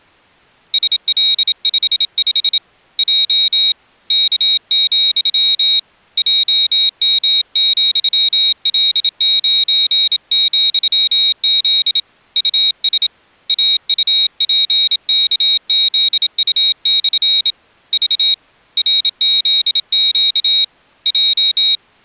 Morse code, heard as a high beeper, hand-sent with a bug key, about 27 wpm, 3800 Hz. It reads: SL55 J K, JM,L9,Z US AUPKZU/ V RZQ J